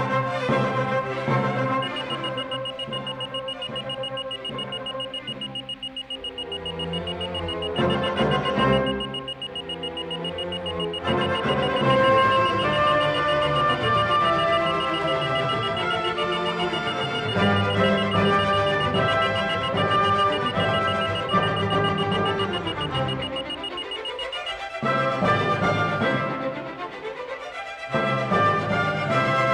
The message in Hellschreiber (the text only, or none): none